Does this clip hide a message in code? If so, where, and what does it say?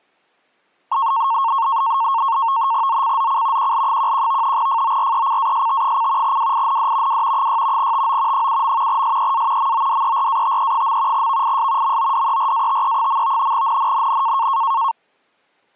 Yes: NAVTEX (SITOR-B), 100 baud, 170 Hz shift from 0.9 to 14.9 s, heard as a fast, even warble, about 1000 Hz centre. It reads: ZCZC QL11 FORECAST: WIND W 6 TO 7. SEA MODERATE. VIS MODERATE. NNNN